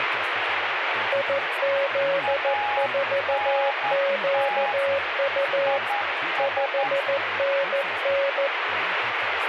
Morse code, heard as two keyed tones, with radio static and speech in Spanish. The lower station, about 14 wpm, 550 Hz: IZ4QU 5NN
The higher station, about 11 wpm, 820 Hz: ANT IS